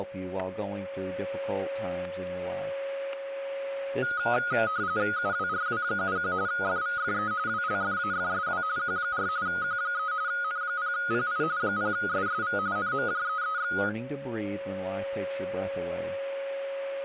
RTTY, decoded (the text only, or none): UWRW71 FVFE WLFAFSW Q4 Q3 N0PI 0SSV NMJEEX